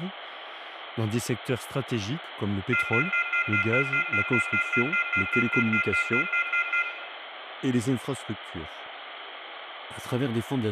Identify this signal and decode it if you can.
Telephone call progress tone (North American plan), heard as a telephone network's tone, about 1400, 2050, 2450, 2600 Hz, 0.1 s on and 0.1 s off, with phone line noise and room echo. Off-hook warning tone.